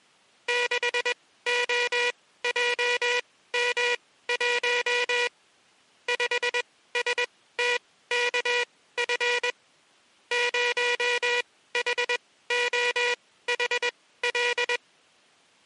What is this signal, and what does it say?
Morse code, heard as a buzzer, machine-sent, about 21 wpm, spaced as for 15 wpm. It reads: 6OJM1 5STKF 0HOHL